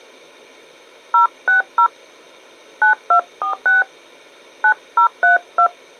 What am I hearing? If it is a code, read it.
DTMF, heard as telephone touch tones, dialled by hand, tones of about 120 ms. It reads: 060 9246 9032